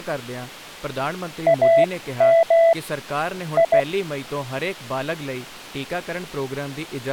Morse code, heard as a keyed tone, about 16 wpm, spaced as for 13 wpm, 660 Hz, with speech in Punjabi. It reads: AM I